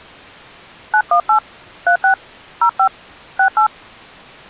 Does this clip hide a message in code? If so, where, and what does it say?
Yes: DTMF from 0.9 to 3.7 s, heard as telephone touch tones, dialled by hand, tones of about 80 ms. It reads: 918 36 05 68